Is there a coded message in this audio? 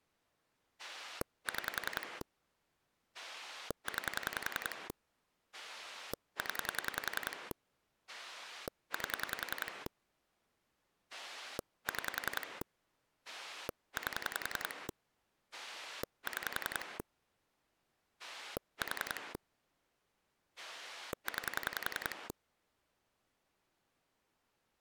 Yes: pulse dialling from 0.8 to 22.3 s, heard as a rotary dial, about 10 pulses a second. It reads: 6 9 0 8 6 8 6 4 9